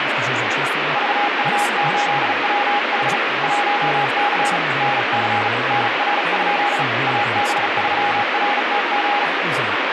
Morse code, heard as a keyed tone, hand-sent with a bug key, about 36 wpm, 820 Hz, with heavy radio static and speech in English. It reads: VU8WH 1C NC NR? AB3RTG